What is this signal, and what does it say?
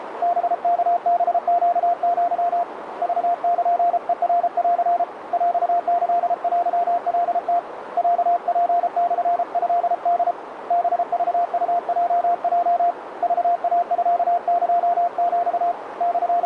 Morse code (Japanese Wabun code), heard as a keyed tone, hand-sent with a paddle, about 33 wpm, 700 Hz, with radio static and a narrow filter. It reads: ハワハネア クルヘナン ヰキテカム ロツモトホ ハクウヲヲ クイミエヒ …